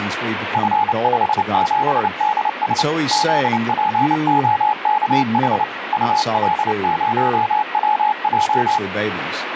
Morse code, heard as a keyed tone, machine-sent, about 29 wpm, 850 Hz, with radio static, a weaker station near 1920 Hz and speech in English. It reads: F57DS ZPOKH UL0WJ